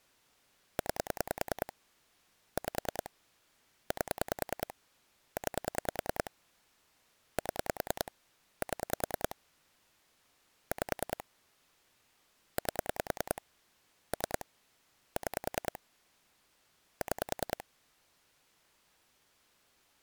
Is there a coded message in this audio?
Yes: pulse dialling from 0.8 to 17.6 s, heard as clicks on a phone line, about 10 pulses a second. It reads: 9 5 8 9 7 7 5 8 3 6 6